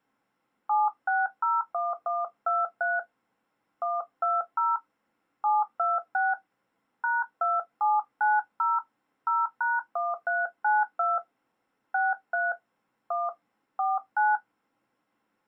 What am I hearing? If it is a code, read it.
DTMF, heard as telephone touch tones, dialled by hand, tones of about 190 ms. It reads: 7601123 120 726 #2790 0#1392 63 1 49